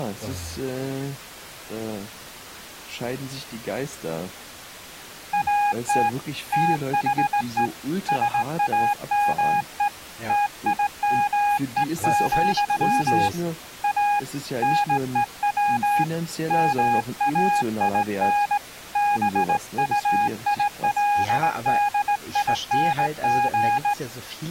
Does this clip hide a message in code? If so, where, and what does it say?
Yes: Morse code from 5.3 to 24.0 s, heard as a keyed tone, hand-sent with a straight key, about 18 wpm, 820 Hz, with speech in German. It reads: AT THE SAME TIME, A NEW MAIN BUILDING